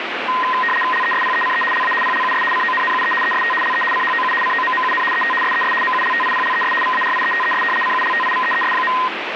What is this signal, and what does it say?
RTTY (75 baud, 850 Hz shift), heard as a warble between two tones, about 1450 Hz centre, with radio static. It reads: LESPECE LA PLUS CONNUE EST LE CHOU COMMUN ET SES MULTIPLES VARIETES CULTIVEES.